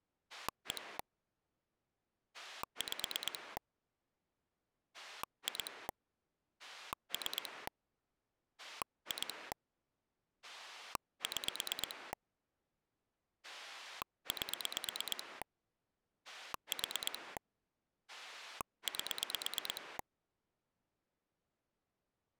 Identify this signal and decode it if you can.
Pulse dialling, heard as a rotary dial, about 8 pulses a second. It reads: 1 5 2 3 2 6 8 4 8